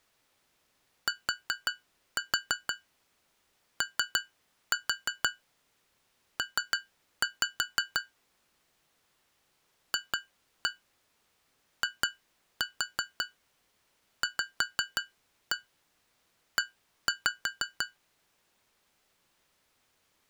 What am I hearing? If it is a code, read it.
Tap code, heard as taps on glass, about 5 knocks a second. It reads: TOP FIVE